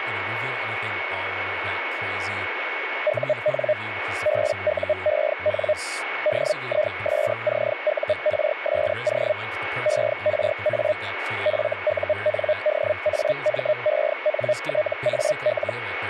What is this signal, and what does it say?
Hellschreiber (Feld-Hell, 122.5 baud), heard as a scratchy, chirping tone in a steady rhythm, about 610 Hz, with radio static, a steady whistle near 2210 Hz and speech in English. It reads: UN BUEN DISCURSO ERA FUNDAMENTAL